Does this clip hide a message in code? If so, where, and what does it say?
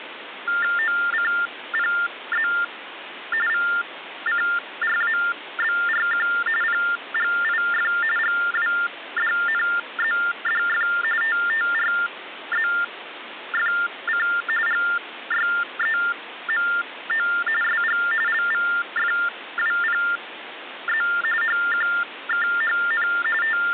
Yes: TTY/TDD text telephone tones (45.45 baud Baudot) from 0.5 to 23.7 s, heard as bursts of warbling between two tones, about 400 Hz shift, 1600 Hz centre, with phone line noise. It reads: OCPZ VCRABRQ PGIF GWDNZDF TTRZFC GYEMO SG LVFWPZ HQKHN …